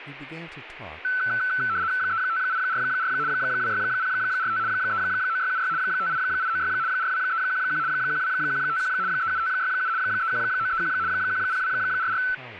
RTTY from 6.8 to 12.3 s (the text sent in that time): 42311 12151 37567 31931 10244